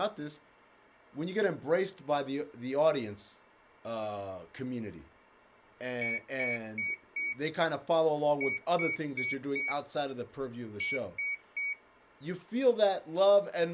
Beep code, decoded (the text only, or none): 4-4-3